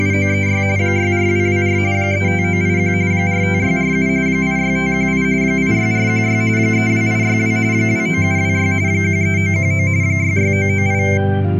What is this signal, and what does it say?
RTTY (45.45 baud, 170 Hz shift), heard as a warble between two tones, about 2200 Hz centre. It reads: … 64224 35981 45647 86518 86416 32862 29726 13919 66998